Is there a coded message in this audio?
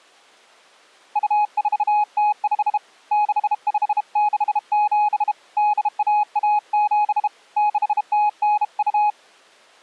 Yes: Morse code (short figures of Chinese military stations) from 1.1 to 9.2 s, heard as a keyed tone, hand-sent with a bug key, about 32 wpm, 840 Hz. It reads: 2405 6567 8117 6092